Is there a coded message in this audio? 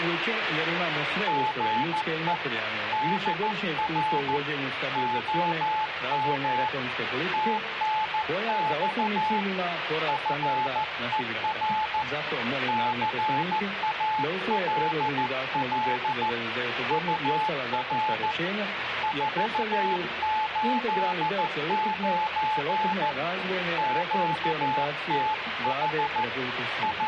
Yes: Morse code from 1.2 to 27.1 s, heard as a keyed tone, hand-sent with a paddle, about 14 wpm, 860 Hz, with radio static. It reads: GE DR OM TNX FER CALL UR 489 QTH …